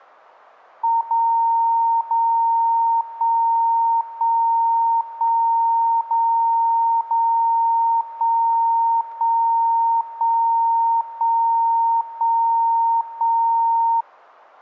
Radio time signal (DCF77), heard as a tone whose level steps once a second, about 920 Hz. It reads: 0 0 1 1 1 0 0 1 1 1 1 1 1